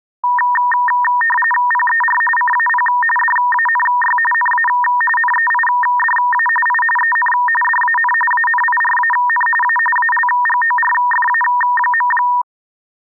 RTTY (45.45 baud, 850 Hz shift), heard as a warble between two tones, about 1400 Hz centre. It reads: PER CAP DANY NA NEIDA I EN DAN ANIRAN A ALGORFA.